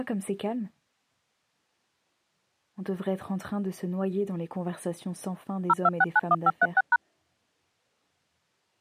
DTMF, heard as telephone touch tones, dialled by machine, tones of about 40 ms. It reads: 02691536#